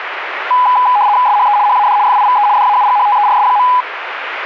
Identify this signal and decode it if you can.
RTTY (75 baud, 170 Hz shift), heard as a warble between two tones, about 910 Hz centre, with radio static. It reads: SHE HAD FIVE DAUGHTERS.